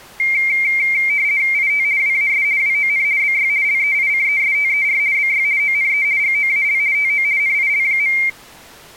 RTTY (50 baud, 170 Hz shift), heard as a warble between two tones, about 2200 Hz centre. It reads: IT WAS WON BY LEICESTER BY ONE GOAL TO NIL.